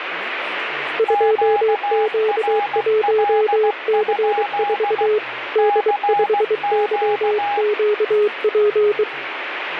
Morse code, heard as two keyed tones, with radio static and speech in Sindhi. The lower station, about 23 wpm, 420 Hz: 2Q1C4 D5YQP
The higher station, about 16 wpm, 820 Hz: QRL? CQ